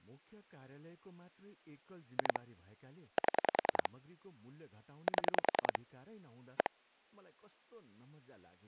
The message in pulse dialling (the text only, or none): 2 7 7 1